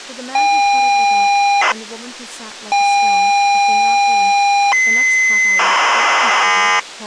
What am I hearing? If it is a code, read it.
ZX Spectrum tape loading, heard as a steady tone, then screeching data, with speech in English.